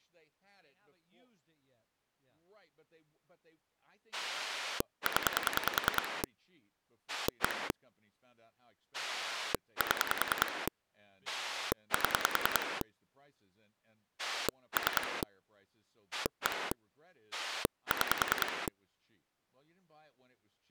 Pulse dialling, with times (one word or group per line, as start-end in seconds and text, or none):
4.1-6.2 0
7.1-7.7 1
8.9-10.7 7
11.3-12.8 7
14.2-15.2 3
16.1-16.7 1
17.3-18.7 6